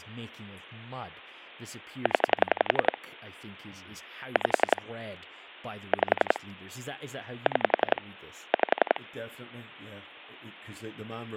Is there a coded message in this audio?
Yes: pulse dialling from 2.1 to 9.0 s, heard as clicks on a phone line, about 11 pulses a second, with speech in English. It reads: 0 5 5 6 5